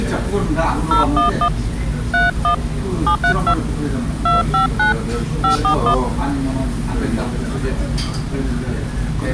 DTMF, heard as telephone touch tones, dialled by hand, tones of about 120 ms, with the noise of a restaurant. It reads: 011 31 732 259 541